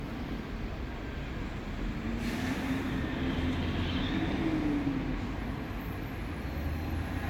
Street noise. There is no code.